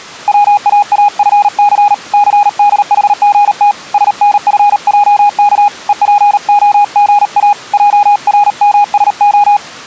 Morse code, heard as a keyed tone, hand-sent with a paddle, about 38 wpm, 820 Hz. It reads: WAAFC CDHGT SNFJK EPOGA JRMSO